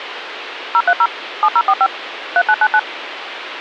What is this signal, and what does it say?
DTMF, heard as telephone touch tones, dialled by machine, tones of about 60 ms, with phone line noise. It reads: 030 7045 3999